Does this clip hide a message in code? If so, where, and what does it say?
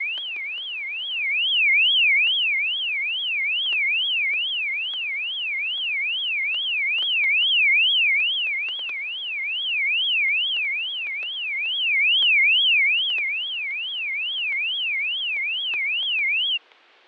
No, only a tone that sweeps in pitch again and again, with fading and static crashes.